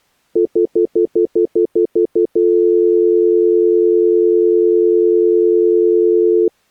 Telephone call progress tone (North American plan), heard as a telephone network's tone, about 350, 440 Hz, 0.1 s on and 0.1 s off. Stutter dial tone.